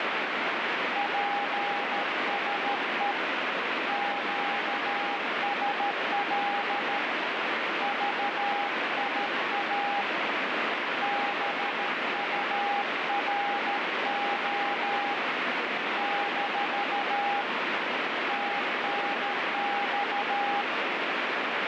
Morse code, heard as a keyed tone, hand-sent with a paddle, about 13 wpm, 810 Hz, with heavy radio static. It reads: PSE QSL VIA BURO - TNX